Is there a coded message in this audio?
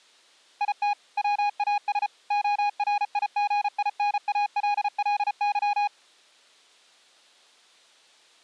Yes: Morse code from 0.6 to 5.9 s, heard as a keyed tone, machine-sent, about 34 wpm, 820 Hz. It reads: IT WAS ORIGINALLY